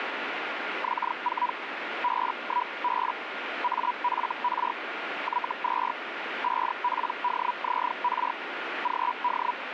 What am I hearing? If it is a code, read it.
Hellschreiber (Feld-Hell, 122.5 baud), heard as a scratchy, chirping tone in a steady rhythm, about 980 Hz, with radio static. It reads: X4 B1B AFR Y2 5PDZR GD